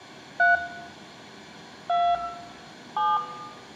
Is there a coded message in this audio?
Yes: DTMF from 0.4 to 3.2 s, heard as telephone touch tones, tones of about 240 ms, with room echo. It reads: 3 2 7